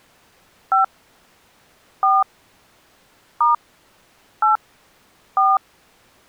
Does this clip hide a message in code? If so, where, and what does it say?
Yes: DTMF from 0.7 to 5.6 s, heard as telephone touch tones, dialled by hand, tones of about 170 ms. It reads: 5 4 * 8 4